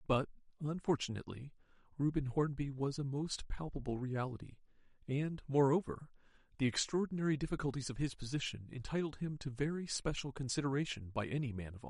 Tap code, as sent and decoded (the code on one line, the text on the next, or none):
none